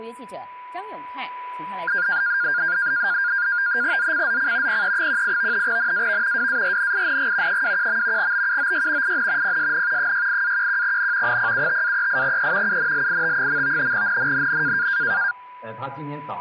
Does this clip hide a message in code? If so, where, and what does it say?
Yes: NAVTEX (SITOR-B), 100 baud, 170 Hz shift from 1.9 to 15.3 s, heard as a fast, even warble, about 1500 Hz centre, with a steady whistle near 990 Hz. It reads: ZCZC PE18 NAV WARNING 21. BUOY IN PSN 68-11N 075-38E UNLIT. NNNN